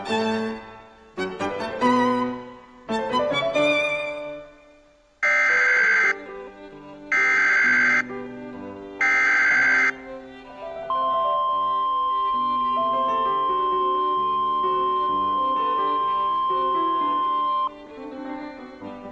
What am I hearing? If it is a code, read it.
Emergency Alert System (SAME) tones (header bursts, then the 1050 Hz attention tone), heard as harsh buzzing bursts, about 520.83 baud.